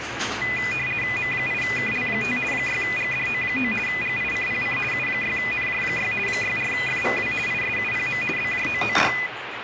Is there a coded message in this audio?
Yes: RTTY (50 baud, 450 Hz shift) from 0.4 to 9.3 s, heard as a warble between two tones, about 2250 Hz centre, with radio static and the noise of a restaurant. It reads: M8KL5 6GDO9 GICPC U6NJ6 64FVW ISUPM BJOOD